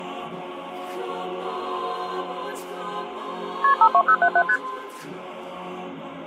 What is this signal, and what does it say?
Multi-frequency trunk signalling (R1, as on North American trunks), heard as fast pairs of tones, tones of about 70 ms. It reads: KP 52077 ST